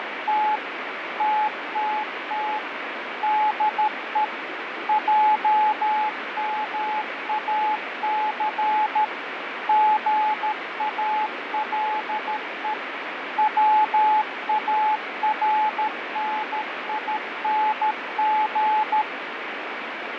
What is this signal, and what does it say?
Morse code, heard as a keyed tone, machine-sent, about 13 wpm, 860 Hz, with radio static and fading. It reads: … TTT DE JMAC GALE WARNING